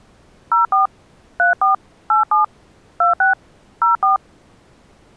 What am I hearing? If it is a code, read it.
DTMF, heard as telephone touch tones, dialled by hand, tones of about 140 ms. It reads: 04 34 87 26 04